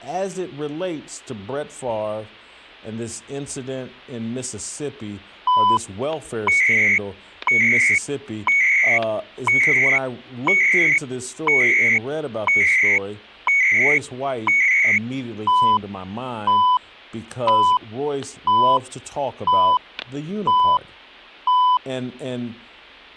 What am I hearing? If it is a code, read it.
Radio time signal (CHU, Canada), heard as beeps and data bursts, one a second, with static crashes and speech in English.